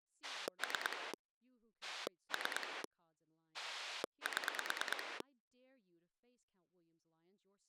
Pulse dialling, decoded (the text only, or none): 3 3 7